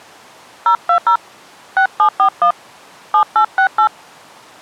DTMF, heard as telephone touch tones, dialled by hand, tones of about 90 ms. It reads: 020 6741 7868